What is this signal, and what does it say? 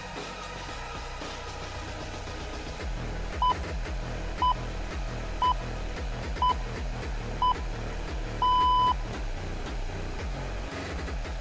Radio time signal (six pips, as the Greenwich Time Signal), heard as pips.